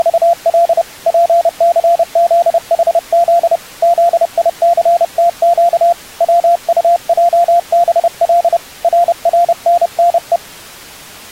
Morse code, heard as a keyed tone, hand-sent with a paddle, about 30 wpm, 690 Hz. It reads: … PCZHZ ZICTQ WUJBL RRNNE